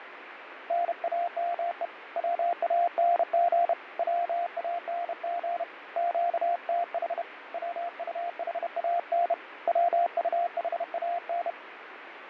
Morse code, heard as a keyed tone, hand-sent with a bug key, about 31 wpm, 690 Hz, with radio static and fading. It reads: NAME WANG WANG QTH WUHAN WUHAN